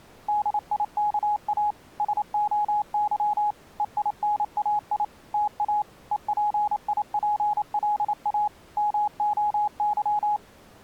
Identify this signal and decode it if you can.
Morse code (Greek alphabet), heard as a keyed tone, machine-sent, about 28 wpm, 840 Hz. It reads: ΔΙΚΑ ΣΟΥ ΕΙΝΑΙ ΤΑ ΕΠΙΠΛΑ ΜΟΥ